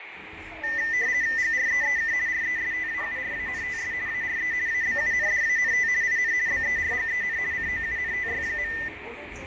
RTTY (50 baud, 170 Hz shift), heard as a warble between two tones, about 1900 Hz centre, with radio static, fading and the noise inside a subway train. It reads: GREEK RESTAURANTS ARE ABUNDANT IN BERGEN COUNTY.